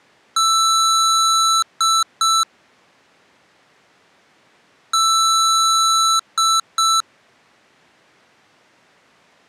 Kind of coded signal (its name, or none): beep code